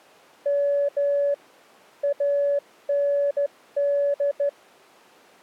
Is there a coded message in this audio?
Yes: Morse code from 0.4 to 4.6 s, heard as a keyed tone, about 13 wpm, 570 Hz. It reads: M AND